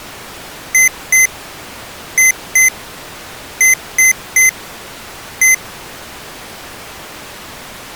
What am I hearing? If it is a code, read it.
Beep code, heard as beeps from a small speaker, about 2050 Hz. 2-2-3-1. In Phoenix BIOS tables: unexpected interrupt.